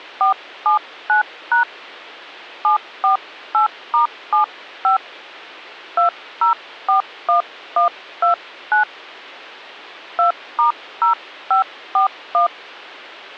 DTMF, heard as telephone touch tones, dialled by hand, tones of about 120 ms. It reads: 479# 748*75 2041129 2*0541